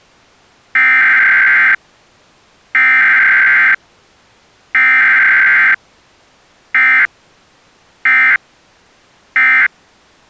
Emergency Alert System (SAME) tones (header bursts, then end-of-message bursts), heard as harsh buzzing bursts, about 520.83 baud.